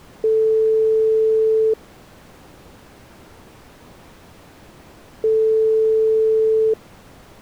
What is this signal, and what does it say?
Telephone call progress tone (single-tone plan, as in most of Europe), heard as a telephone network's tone, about 440 Hz, 1.5 s on and 3.5 s off. Ringback tone.